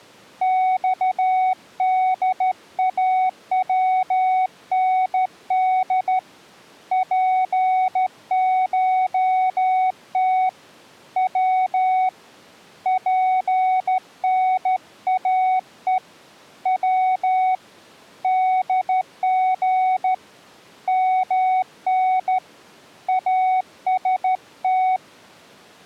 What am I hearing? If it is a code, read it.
Morse code (Persian alphabet), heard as a keyed tone, hand-sent with a straight key, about 13 wpm, 750 Hz. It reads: خداوند پشت و پناه و دژ من است